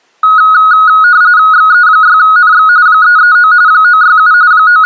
RTTY (45.45 baud, 170 Hz shift), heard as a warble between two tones, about 1360 Hz centre. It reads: XE6NX 339 967 …